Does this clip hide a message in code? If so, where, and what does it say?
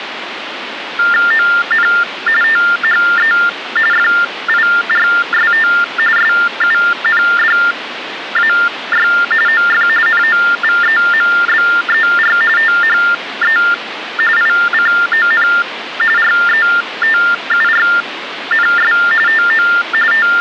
Yes: TTY/TDD text telephone tones (45.45 baud Baudot) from 1.0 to 20.4 s, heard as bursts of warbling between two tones, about 400 Hz shift, 1600 Hz centre, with phone line noise. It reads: ON THE FIRST SUNDAY OF NOVEMBER THE ICON RETURNS TO …